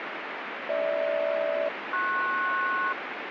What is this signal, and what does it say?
Aircraft SELCAL, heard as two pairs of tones, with radio static. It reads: GH-PS